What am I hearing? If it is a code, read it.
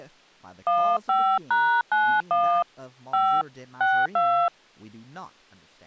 DTMF, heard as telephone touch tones, dialled by hand, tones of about 290 ms, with speech in English. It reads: 15#91 5 62